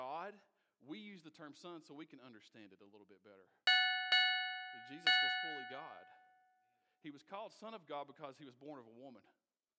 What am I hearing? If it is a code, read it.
Ship's bell, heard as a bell, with speech in English. 3. Three half-hours of the watch have passed.